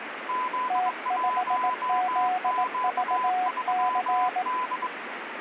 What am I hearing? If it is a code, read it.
Morse code, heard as two keyed tones, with radio static. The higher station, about 22 wpm, 1010 Hz: Z1Q3D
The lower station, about 18 wpm, 730 Hz: T5ZVC